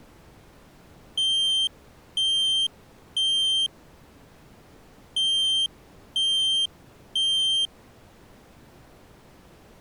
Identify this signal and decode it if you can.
Alarm pattern, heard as an alarm's beeps, played twice, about 3150 Hz. Temporal three. Smoke or fire, evacuate.